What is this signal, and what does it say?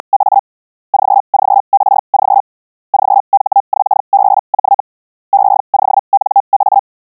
Hellschreiber (Feld-Hell, 122.5 baud), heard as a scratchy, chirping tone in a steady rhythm, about 800 Hz. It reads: … GGRG GHXBJ EONA